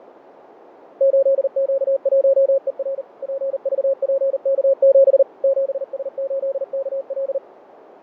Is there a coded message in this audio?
Yes: Morse code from 0.9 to 7.4 s, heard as a keyed tone, machine-sent, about 39 wpm, 540 Hz, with radio static and fading. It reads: 8Q1ER PVPK7 7S8KL